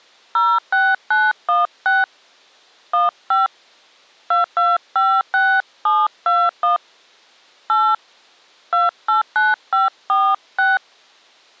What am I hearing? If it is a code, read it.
DTMF, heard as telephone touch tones, dialled by hand, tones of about 200 ms. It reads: 06916 15 2256721 8 289546